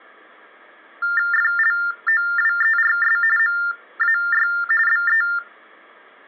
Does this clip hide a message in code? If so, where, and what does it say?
Yes: TTY/TDD text telephone tones (45.45 baud Baudot) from 1.0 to 5.4 s, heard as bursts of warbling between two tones, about 400 Hz shift, 1600 Hz centre. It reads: FLOWERS MAY BE